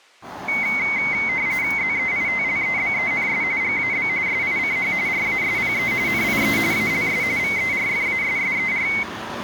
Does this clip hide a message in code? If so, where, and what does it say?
Yes: RTTY (45.45 baud, 170 Hz shift) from 0.5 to 9.0 s, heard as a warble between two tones, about 2150 Hz centre, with street noise. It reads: ZEITLEBENS GAB SICH RASPE NIE ALS VERFASSER